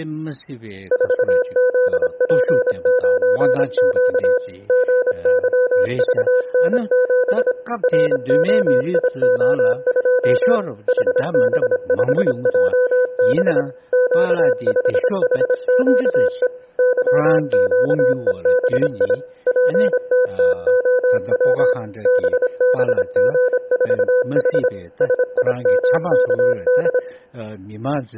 Morse code, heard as a keyed tone, machine-sent, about 26 wpm, 500 Hz, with room echo. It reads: 4ZP9Q GYVN7 ROIO2 HB5JB Q5HQE YQEBI PTTOW BBG4H SIMKD